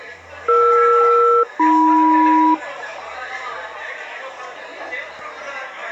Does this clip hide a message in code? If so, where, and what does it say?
Yes: aircraft SELCAL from 0.5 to 2.5 s, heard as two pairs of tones, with the noise of a crowd indoors. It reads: ER-AM